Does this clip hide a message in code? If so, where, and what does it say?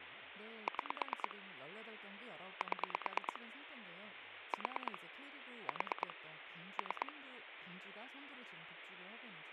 Yes: pulse dialling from 0.7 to 7.1 s, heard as clicks on a phone line, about 9 pulses a second, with phone line noise and speech in Korean. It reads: 6 7 4 4 3